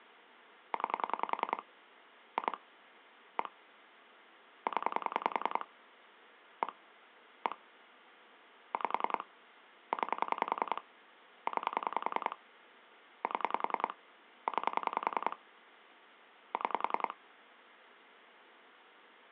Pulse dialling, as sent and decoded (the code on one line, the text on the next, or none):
9 / 2 / 1 / 10 / 1 / 1 / 5 / 9 / 9 / 7 / 9 / 6
9 2 1 0 1 1 5 9 9 7 9 6